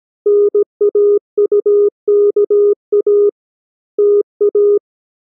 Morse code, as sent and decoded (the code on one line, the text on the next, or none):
-. .- ..- -.- .- / - .-
NAUKA TA